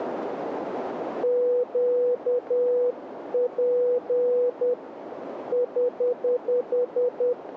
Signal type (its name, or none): Morse code